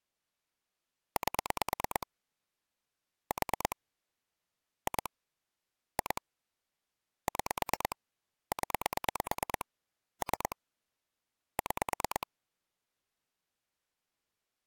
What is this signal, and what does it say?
Pulse dialling, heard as clicks on a phone line, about 9 pulses a second. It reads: 8 4 2 2 6 0 3 6